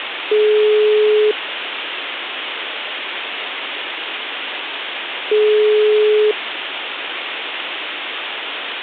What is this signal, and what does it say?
Telephone call progress tone (single-tone plan, as in most of Europe), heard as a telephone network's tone, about 420 Hz, 1 s on and 4 s off, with phone line noise. Ringback tone.